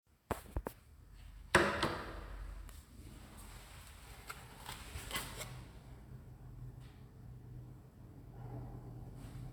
The noise inside a lift. There is no code.